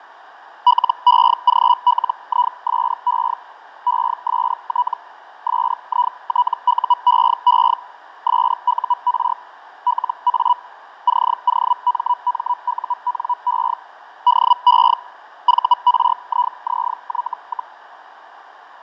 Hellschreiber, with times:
0.7-3.3 LEGLISE
3.9-4.9 EST
5.5-7.7 SITUEE
8.3-9.3 SUR
9.9-10.5 LA
11.1-13.7 COMMUNE
14.3-14.9 DE
15.5-17.7 VRIZY,

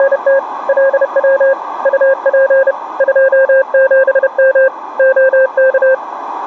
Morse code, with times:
0.0-0.4 …
0.7-1.5 LW
1.9-2.7 UP
3.0-4.7 27M
5.0-5.9 OK

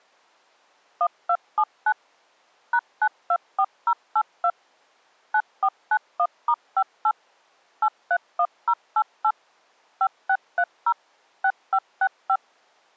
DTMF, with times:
1.0-1.9 1279
2.7-4.5 #924082
5.3-7.1 9491*58
7.8-9.3 831088
10.0-10.9 5630
11.4-12.4 6565

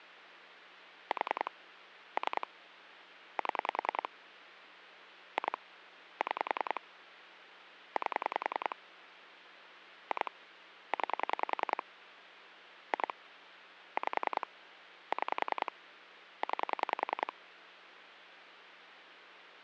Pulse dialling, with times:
1.1-1.5 4
2.2-2.5 3
3.4-4.1 7
5.4-5.6 2
6.2-6.8 6
8.0-8.8 8
10.1-10.3 2
10.9-11.8 9
12.9-13.1 2
14.0-14.5 5
15.1-15.7 6
16.4-17.3 9

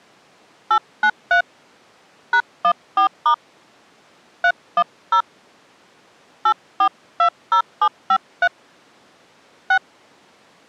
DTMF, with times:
0.7-1.4 893
2.3-3.3 #14*
4.4-5.2 310
6.5-8.5 8420753
9.7-9.8 6

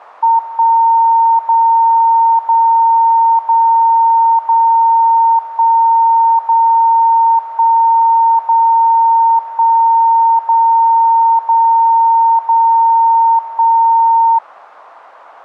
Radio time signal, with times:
0.4-1.4 1
1.4-2.4 0
2.4-3.4 0
3.4-4.4 0
4.4-5.4 0
5.4-6.4 1
6.4-7.4 0
7.4-8.4 1
8.4-9.4 0
9.4-10.4 1
10.4-11.4 0
11.4-12.4 0
12.4-13.4 0
13.4-14.4 1

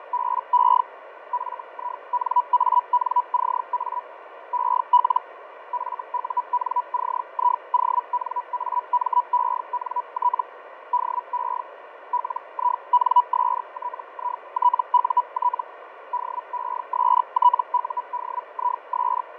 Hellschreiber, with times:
0.0-0.8 …
1.3-4.0 FINANCA
4.5-5.2 EL
5.7-10.4 FUNCIONAMENT
10.9-11.6 DE
12.1-15.6 LINSTITUT
16.1-19.2 DESTUDIS

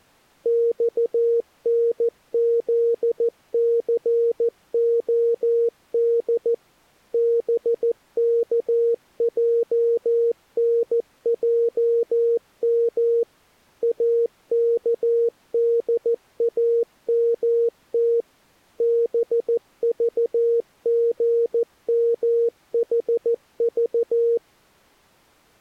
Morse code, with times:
0.5-6.5 XNZCOD
7.1-13.2 BKJNJM
13.8-18.2 AKDAMT
18.8-24.4 BVGMHV

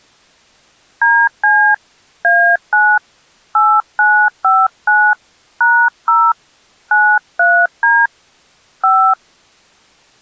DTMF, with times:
1.0-1.7 DC
2.2-3.0 A9
3.6-5.1 8959
5.6-6.3 #0
6.9-8.1 93D
8.8-9.1 5

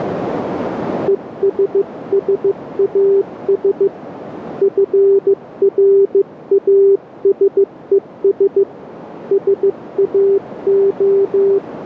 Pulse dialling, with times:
none

